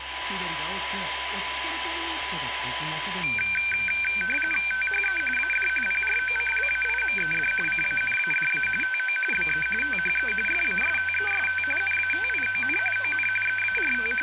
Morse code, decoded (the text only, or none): none